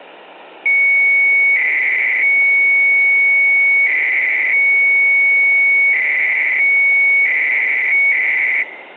300-baud modem data (Bell 103 tones), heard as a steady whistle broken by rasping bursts, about 300 baud, 200 Hz shift.